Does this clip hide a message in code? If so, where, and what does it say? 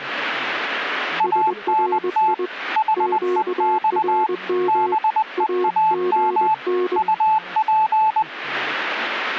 Yes: Morse code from 1.1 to 8.3 s, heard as two keyed tones, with speech in Portuguese. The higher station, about 20 wpm, 870 Hz: ANT HEX BEAM UP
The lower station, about 21 wpm, 360 Hz: SRI QRM AGN